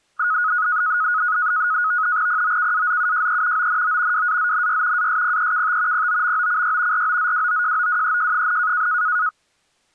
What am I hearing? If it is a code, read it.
NAVTEX (SITOR-B), 100 baud, 170 Hz shift, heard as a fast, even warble, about 1360 Hz centre. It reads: POKAZUJE ONO WAZNY ASPEKT POMOCY ROZWOJOWEJ,